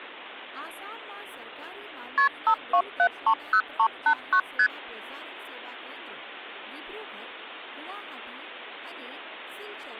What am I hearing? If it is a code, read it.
Multi-frequency trunk signalling (R1, as on North American trunks), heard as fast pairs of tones, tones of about 80 ms, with speech in Gujarati. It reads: KP 52730389 ST